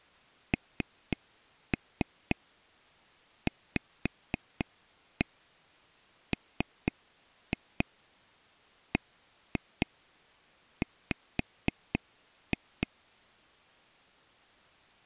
Tap code, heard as taps on a table, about 4 knocks a second. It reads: NVMBW